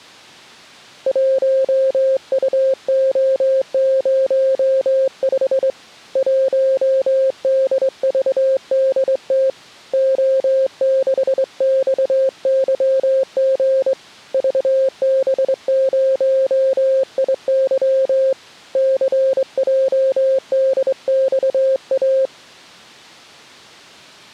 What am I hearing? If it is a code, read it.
Morse code, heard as a keyed tone, hand-sent with a straight key, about 23 wpm, 530 Hz. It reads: 1UO05 1DVDT O6XYG VB0IY CJDXA